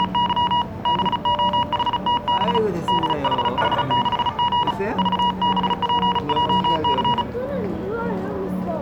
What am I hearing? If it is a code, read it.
Morse code, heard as a keyed tone, hand-sent with a bug key, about 35 wpm, 960 Hz, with the noise of a crowd indoors. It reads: … BOHTB DHH6G VBPJC